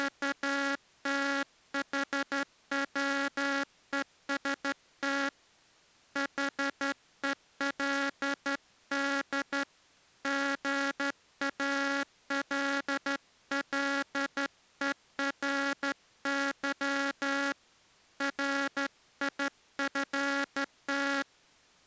Morse code, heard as a buzzer, hand-sent with a straight key, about 12 wpm. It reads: … HELD GALLERY RIFT